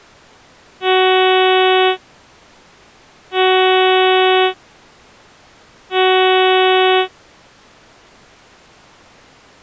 Ship horn signal, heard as a ship's horn, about 370 Hz. 3 short. At sea: I am operating astern propulsion.